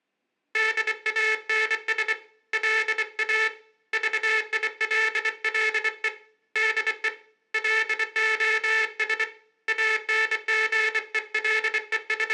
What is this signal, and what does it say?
Morse code, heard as a buzzer, hand-sent with a bug key, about 24 wpm, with room echo. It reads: DANS LA VILLE DE LOS …